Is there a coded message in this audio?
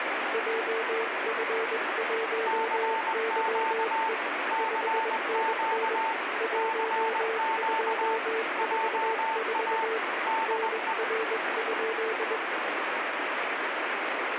Yes: Morse code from 0.3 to 12.4 s, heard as two keyed tones, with heavy radio static. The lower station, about 21 wpm, 450 Hz: JF1YE 5NN 1244 NR?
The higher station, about 20 wpm, 890 Hz: CQ CQ CQ JA DE